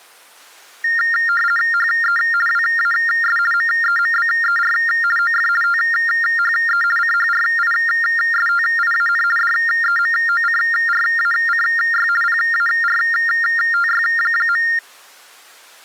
RTTY (50 baud, 450 Hz shift), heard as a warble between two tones, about 1600 Hz centre. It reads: HE WAS MEMBER OF THE CHRISTIAN DEMOCRACY PARTY.